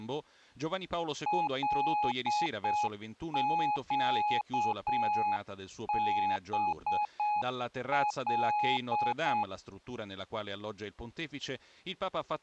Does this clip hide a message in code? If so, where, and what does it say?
Yes: Morse code (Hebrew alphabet) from 1.2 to 9.5 s, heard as a keyed tone, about 7 wpm, 840 Hz. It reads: לקבל